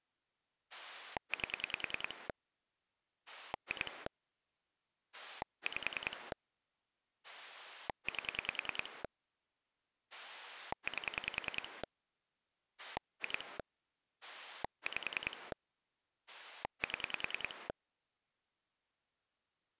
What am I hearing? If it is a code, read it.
Pulse dialling, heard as a rotary dial, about 10 pulses a second. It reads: 8 2 5 8 8 2 5 7